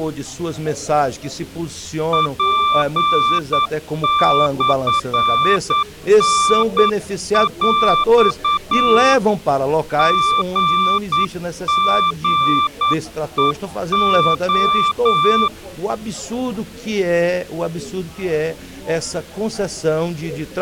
Morse code (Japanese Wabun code), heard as a keyed tone, hand-sent with a paddle, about 9 wpm, 1180 Hz. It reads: ツモタヰ リリヘレ